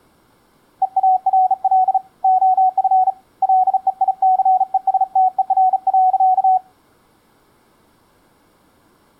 Morse code, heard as a keyed tone, hand-sent with a bug key, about 36 wpm, 740 Hz. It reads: EARL OF LEICESTER.